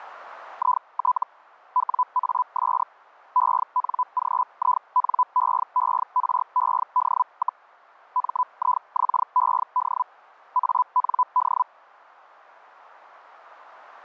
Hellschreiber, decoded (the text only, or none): IT WAS ENGINEERED, MIXED AND